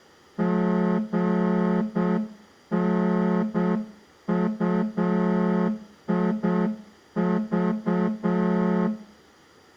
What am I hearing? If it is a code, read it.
Morse code, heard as a horn, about 7 wpm, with room echo. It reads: GNUIV